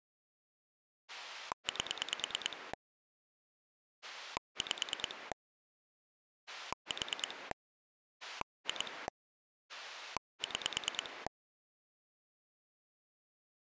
Pulse dialling, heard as a rotary dial, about 9 pulses a second. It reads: 8 5 4 2 6